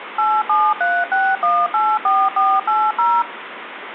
DTMF, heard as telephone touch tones, dialled by machine, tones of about 240 ms, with phone line noise. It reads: 8736184480